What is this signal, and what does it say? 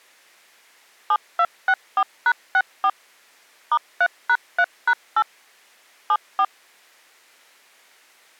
DTMF, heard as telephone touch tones, dialled by machine, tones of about 60 ms. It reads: 7264#64 *3#3#8 74